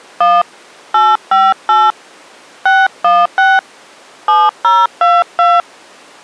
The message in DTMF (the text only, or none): 1 858 616 7022